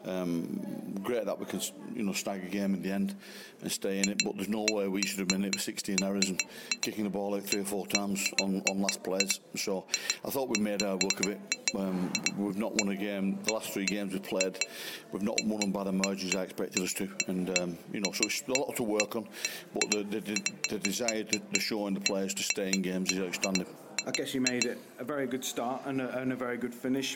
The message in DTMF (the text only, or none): none